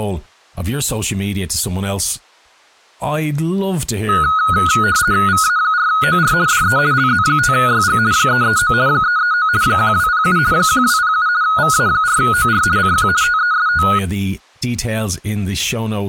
RTTY (50 baud, 170 Hz shift), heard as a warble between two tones, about 1360 Hz centre, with speech in English. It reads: VA4OR DE LZ5YG 339 339 1207 1207 VA4OR CQ TEST